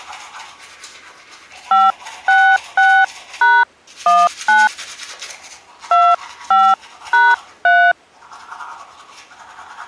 DTMF, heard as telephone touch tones, dialled by hand, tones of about 250 ms, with the noise of a restroom. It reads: 566#19 25#3